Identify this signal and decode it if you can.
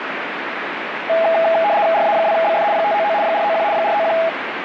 RTTY (75 baud, 170 Hz shift), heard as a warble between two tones, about 740 Hz centre, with radio static. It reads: RA2BF 599 491 491